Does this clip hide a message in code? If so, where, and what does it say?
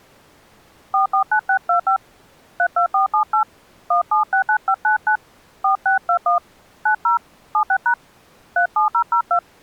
Yes: DTMF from 0.9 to 9.4 s, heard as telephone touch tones, dialled by hand, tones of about 100 ms. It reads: 449625 32478 1769599 4621 90 76# 37002